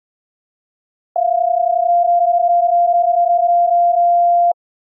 PSK31 (31.25 baud), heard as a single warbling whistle, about 700 Hz.